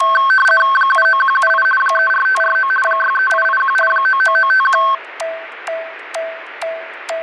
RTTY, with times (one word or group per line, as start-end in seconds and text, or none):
0.8-1.6 79178
1.8-2.7 34549
2.9-3.8 63881
3.9-4.8 99951